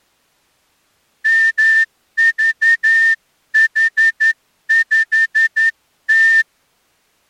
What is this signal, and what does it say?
Morse code, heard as a whistle, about 11 wpm. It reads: MVH5T